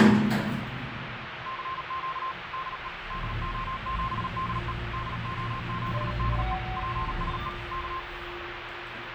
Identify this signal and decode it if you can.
Morse code, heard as a keyed tone, machine-sent, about 38 wpm, 1060 Hz, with radio static and the noise inside a lift. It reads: CQ DE DO7DE DO7DE PSE K